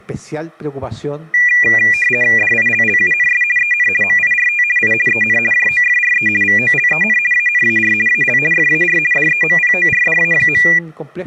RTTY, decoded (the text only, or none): DILLUNS EN MIRT I EN JOFRE VOLEN ANAR AL FAR DEMPORDA.